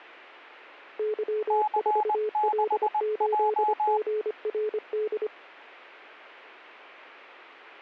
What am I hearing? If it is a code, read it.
Morse code, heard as two keyed tones. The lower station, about 25 wpm, 430 Hz: Y4L8GRD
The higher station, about 20 wpm, 850 Hz: C6J